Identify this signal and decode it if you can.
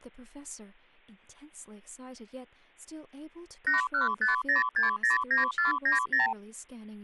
Multi-frequency trunk signalling (R2, with the far end's replies), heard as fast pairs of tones, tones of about 140 ms, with speech in English. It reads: 8150609490